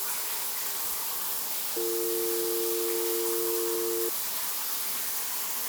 Telephone call progress tone (North American or UK plan), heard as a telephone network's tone, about 350, 450 Hz, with the noise of a restroom. Dial tone.